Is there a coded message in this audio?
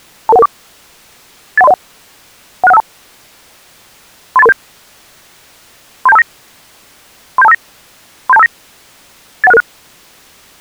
Yes: five-tone selective call (EIA) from 0.3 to 9.6 s, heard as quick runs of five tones, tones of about 30 ms. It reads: 22114 81301 16152 38337 37259 37259 37259 81666